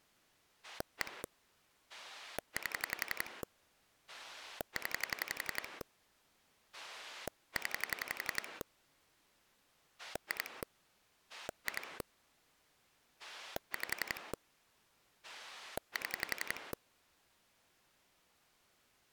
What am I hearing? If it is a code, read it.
Pulse dialling, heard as a rotary dial, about 11 pulses a second. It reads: 1 8 0 0 2 2 5 7